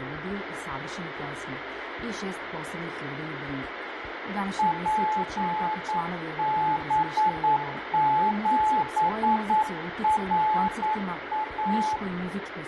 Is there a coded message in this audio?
Yes: Morse code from 4.5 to 12.0 s, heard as a keyed tone, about 9 wpm, 860 Hz, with radio static and room echo. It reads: PB7RA